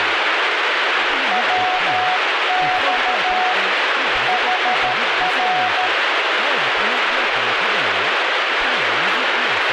Morse code, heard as a keyed tone, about 13 wpm, 740 Hz, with heavy radio static and speech in Assamese. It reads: WX HR